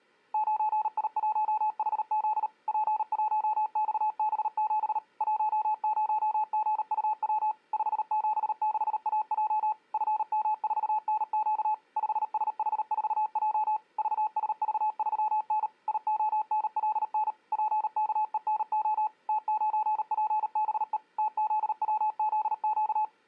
Morse code, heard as a keyed tone, machine-sent, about 38 wpm, 860 Hz. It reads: 9I1HZ P1XB7 10GUW 576AJ FM4NQ 5SH4J VSV3N IONLN PKENO T9PBE TZWZQ